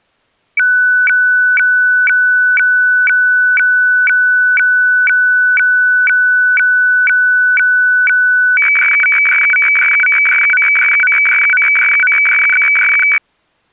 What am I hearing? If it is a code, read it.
Weather fax (radiofax), 120 lines a minute, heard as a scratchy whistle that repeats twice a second.